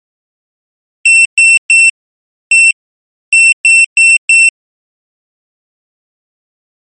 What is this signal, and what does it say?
Beep code, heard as a piezo beeper, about 2700 Hz. 3-1-4. In Phoenix BIOS tables: interrupt mask register failure.